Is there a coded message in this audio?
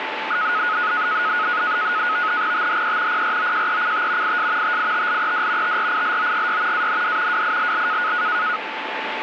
Yes: NAVTEX (SITOR-B), 100 baud, 170 Hz shift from 0.3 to 8.6 s, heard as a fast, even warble, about 1360 Hz centre, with radio static and a steady whistle near 880 Hz. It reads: THE PROJECT IS TITLED TRILOGY AND WILL